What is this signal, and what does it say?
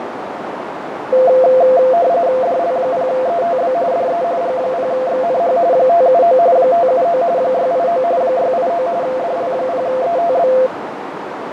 RTTY (45.45 baud, 170 Hz shift), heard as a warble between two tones, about 600 Hz centre, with radio static, fading and a narrow filter. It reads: DL0ETB DE G0XNH 579 579 689 689 DL0ETB